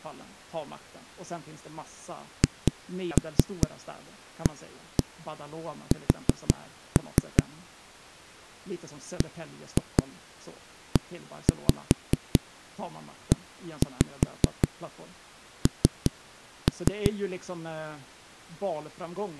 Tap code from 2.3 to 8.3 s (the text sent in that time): HAS